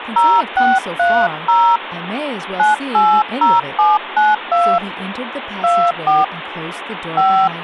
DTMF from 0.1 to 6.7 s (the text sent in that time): 0630 980792 24